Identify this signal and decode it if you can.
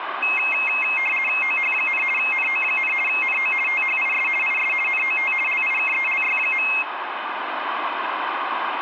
RTTY (50 baud, 450 Hz shift), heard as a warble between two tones, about 2350 Hz centre, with radio static and room echo. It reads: OH, NO, NO THIS IS NOT LIKELY.